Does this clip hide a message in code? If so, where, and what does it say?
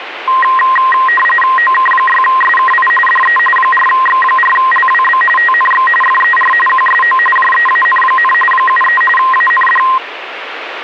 Yes: RTTY (45.45 baud, 850 Hz shift) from 0.3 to 10.0 s, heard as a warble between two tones, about 1470 Hz centre, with radio static. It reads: OK6SKI DE 4X4LWB TNX FER QSO JEAN, 73 AND